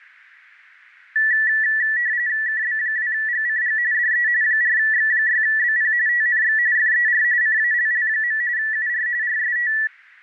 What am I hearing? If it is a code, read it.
RTTY (45.45 baud, 170 Hz shift), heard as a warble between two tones, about 1850 Hz centre. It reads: KB2GCG DE 4X6BP TNX FER CALL. UR RST